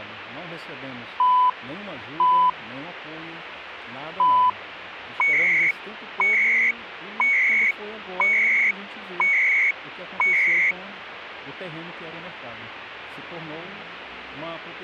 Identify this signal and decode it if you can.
Radio time signal (CHU, Canada), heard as beeps and data bursts, one a second, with radio static.